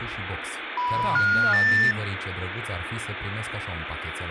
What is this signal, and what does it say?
Telephone call progress tone (North American plan), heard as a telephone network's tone, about 980, 1430, 1800 Hz, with phone line noise and speech in Romanian. Special information tone.